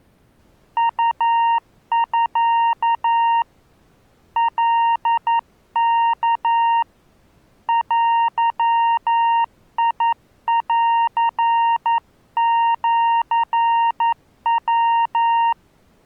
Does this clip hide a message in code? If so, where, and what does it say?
Yes: Morse code (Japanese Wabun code) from 0.7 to 15.6 s, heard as a keyed tone, hand-sent with a paddle, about 11 wpm, 930 Hz. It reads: ウミ カワ デンシヤ